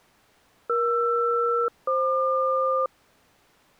Aircraft SELCAL, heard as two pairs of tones. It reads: ER-FQ